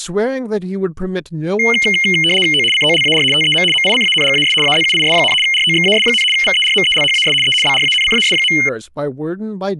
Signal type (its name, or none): RTTY